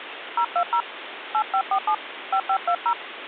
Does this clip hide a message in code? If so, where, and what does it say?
Yes: DTMF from 0.4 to 2.9 s, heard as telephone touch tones, dialled by hand, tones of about 80 ms, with phone line noise. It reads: 020 8547 5520